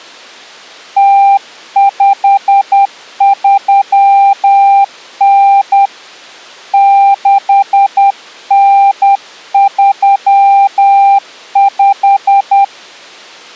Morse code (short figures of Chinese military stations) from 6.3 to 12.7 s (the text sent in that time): 6935